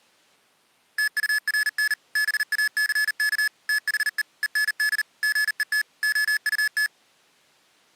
Morse code, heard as electronic beeps, machine-sent, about 39 wpm, 1700 Hz. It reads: TURN BACK THE END GET OUT